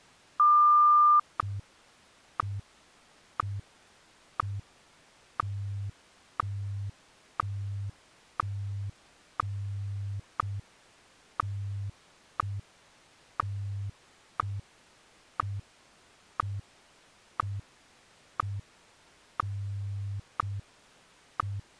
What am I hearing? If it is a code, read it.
Radio time signal (WWVH, Hawaii), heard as ticks, one a second.